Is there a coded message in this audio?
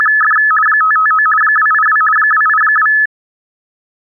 Yes: RTTY (50 baud, 450 Hz shift) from 0.0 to 3.1 s, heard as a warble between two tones, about 1500 Hz centre. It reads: … 559 282 282